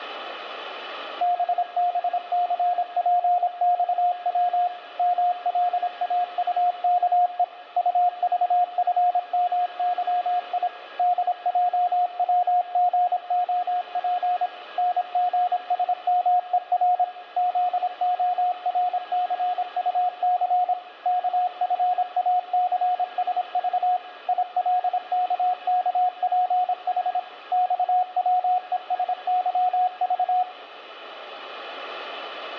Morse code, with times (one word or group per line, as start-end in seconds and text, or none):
1.2-4.7 BBCPXW
5.0-7.4 MLAUKE
7.8-10.7 UVFMYI
11.0-14.5 DJWGOP
14.8-17.0 NGSMER
17.4-20.7 ZORCUC
21.1-24.0 KFACSV
24.3-27.2 ILKKPH
27.5-30.4 XWESYV